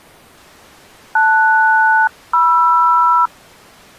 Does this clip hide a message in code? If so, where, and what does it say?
Yes: aircraft SELCAL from 1.2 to 3.3 s, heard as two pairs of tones. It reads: LS-MR